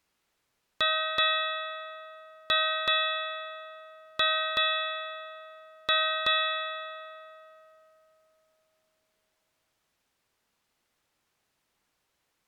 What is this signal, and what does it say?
Ship's bell, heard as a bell. 8. Eight half-hours of the watch have passed.